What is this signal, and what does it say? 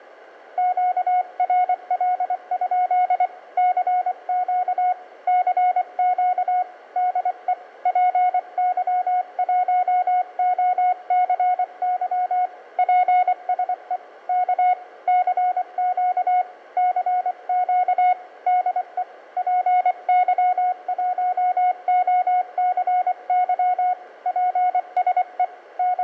Morse code, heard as a keyed tone, hand-sent with a paddle, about 24 wpm, 730 Hz, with room echo. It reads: QRL? CQ CQ DE PY1OCY PSE K CQ CQ DE PY1OCY PSE …